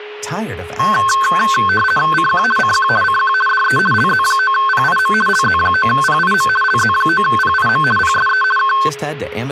RTTY (50 baud, 450 Hz shift), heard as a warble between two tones, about 1300 Hz centre, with a steady whistle near 420 Hz and speech in English. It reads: CQ CQ CQ DE LZ9PIM LZ9PIM LZ9PIM PSE K